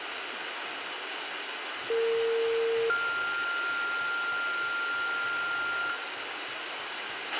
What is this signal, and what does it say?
Two-tone page, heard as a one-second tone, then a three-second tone, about 460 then 1400 Hz, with radio hiss, a squelch burst at the end and room echo.